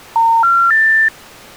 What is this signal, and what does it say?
Telephone call progress tone (North American plan), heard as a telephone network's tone, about 910, 1370, 1800 Hz. Special information tone.